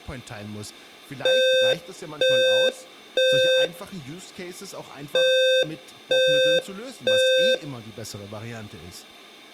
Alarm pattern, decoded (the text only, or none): temporal three